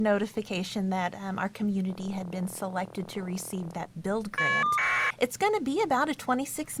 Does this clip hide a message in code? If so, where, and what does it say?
Yes: caller ID data burst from 1.9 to 5.1 s, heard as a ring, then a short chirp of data, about 1200 baud.